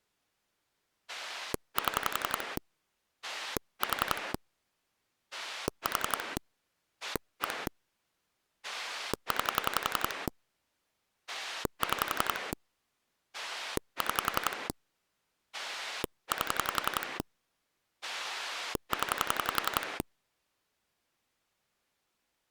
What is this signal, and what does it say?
Pulse dialling, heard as a rotary dial, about 11 pulses a second. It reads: 7 4 4 1 9 6 6 8 0